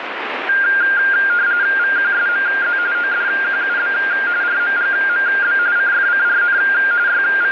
RTTY (45.45 baud, 170 Hz shift), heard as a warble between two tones, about 1500 Hz centre, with radio static. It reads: VQSMZ ODQUB RMGMB CFCRN …